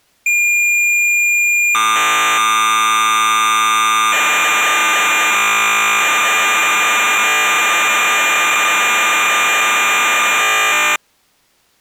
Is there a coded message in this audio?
Yes: cassette data (Kansas City type), 1200 baud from 0.3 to 11.0 s, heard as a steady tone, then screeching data.